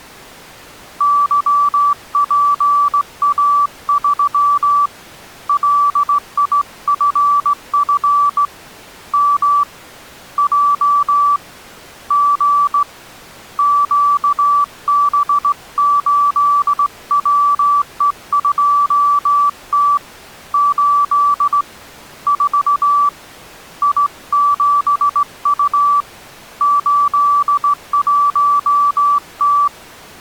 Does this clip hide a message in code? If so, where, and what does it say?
Yes: Morse code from 0.9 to 29.7 s, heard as a keyed tone, hand-sent with a straight key, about 17 wpm, 1160 Hz. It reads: YPA3 LIFF M J G QB8WE2T 8 4 I7U 81T